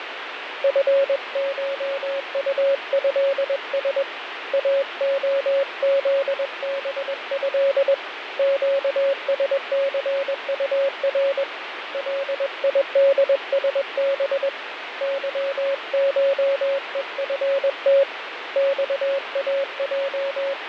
Morse code (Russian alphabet), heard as a keyed tone, hand-sent with a paddle, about 21 wpm, 550 Hz, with radio static and fading. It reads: ФШУЭС АОЗБЭ ЩСЦУР ЛИДСБ ЫШЕФТ …